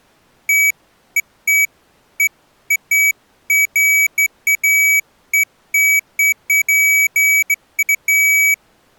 Beeps of irregular length. There is no code.